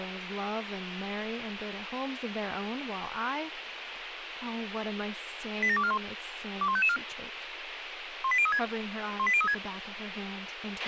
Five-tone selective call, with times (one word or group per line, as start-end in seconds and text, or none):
5.6-6.0 87241
6.6-7.0 21554
8.2-8.6 18036
9.2-9.5 18036